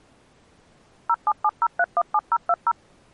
DTMF, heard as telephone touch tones, dialled by machine, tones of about 50 ms. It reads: 0770317020